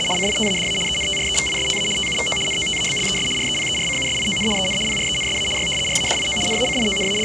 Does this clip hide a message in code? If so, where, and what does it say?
Yes: RTTY (75 baud, 850 Hz shift) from 0.0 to 7.2 s, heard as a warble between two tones, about 2550 Hz centre, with the noise of a cafe. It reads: … CITADA ENTREVISTA TUVO NOTABLES REPERCUSION EN PRENSA Y RADIO …